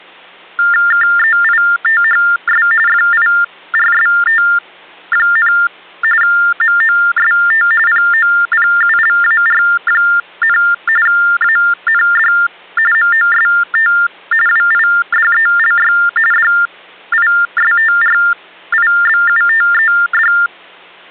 TTY/TDD text telephone tones (45.45 baud Baudot), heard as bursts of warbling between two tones, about 400 Hz shift, 1600 Hz centre, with hum. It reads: KEITHS FIRST, MOST POPULAR, AND MOST WIDELY DISTRIBUTED